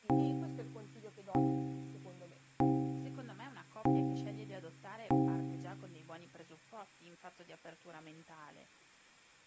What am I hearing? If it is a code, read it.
Clock strike, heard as a bell, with room echo and speech in Italian. 5. Five o'clock.